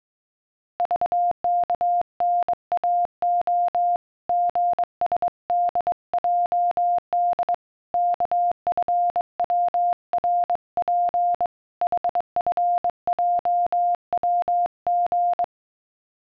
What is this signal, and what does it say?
Morse code, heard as a keyed tone, hand-sent with a straight key, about 22 wpm, 700 Hz. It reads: VKNAO GSDJD KFWRP HFJWG